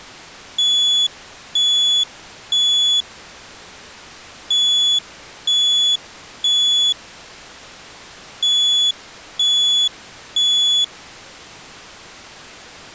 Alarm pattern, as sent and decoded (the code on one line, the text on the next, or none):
3 beeps and a pause
temporal three